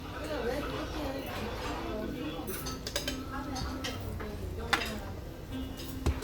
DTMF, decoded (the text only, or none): none